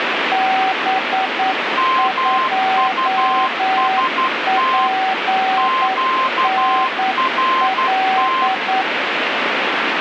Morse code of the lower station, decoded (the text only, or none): B2PNL